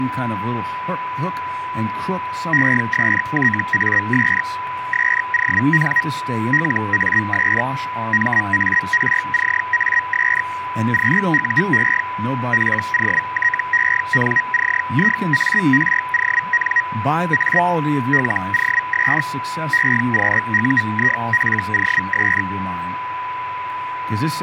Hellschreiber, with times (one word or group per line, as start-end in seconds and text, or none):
2.5-4.4 ESTAS
4.9-6.0 SON
6.5-7.6 LAS
8.1-10.4 MARCAS
10.9-12.0 QUE
12.5-16.8 POTENCIARON
17.3-17.6 A
18.1-19.2 LOS
19.7-22.4 EQUIPOS